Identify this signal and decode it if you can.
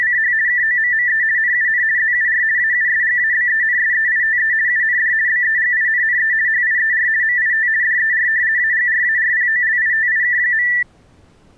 RTTY (50 baud, 170 Hz shift), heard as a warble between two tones, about 1850 Hz centre. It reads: … KOMME NUN ZUR AUSGABENSEITE UND BEGINNE HIER MIT DER AGRARPOLITIK.